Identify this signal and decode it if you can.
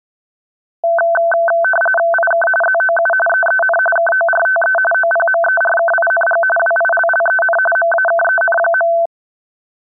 RTTY (45.45 baud, 850 Hz shift), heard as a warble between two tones, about 1100 Hz centre. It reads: IK ZOU EEN KORTE OPMERKING WILLEN MAKEN.